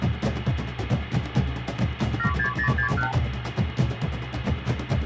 Multi-frequency trunk signalling (R2, with the far end's replies), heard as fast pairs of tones, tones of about 100 ms, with phone line noise. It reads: 76061